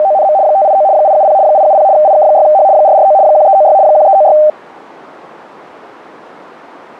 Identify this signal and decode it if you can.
RTTY (75 baud, 170 Hz shift), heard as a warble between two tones, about 700 Hz centre, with radio static. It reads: … 589 870 870 IK6H 449 1396 1396